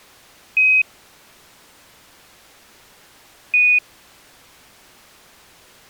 Quindar tones, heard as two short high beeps.